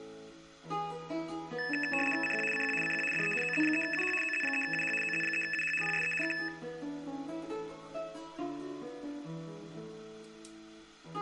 RTTY (75 baud, 850 Hz shift), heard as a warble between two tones, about 2150 Hz centre. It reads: CQ CQ CQ DE OZ3UH OZ3UH OZ3UH PSE K